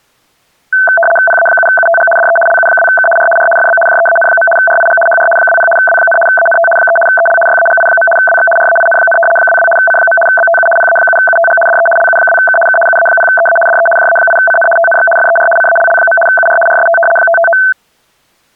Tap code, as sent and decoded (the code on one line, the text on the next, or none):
none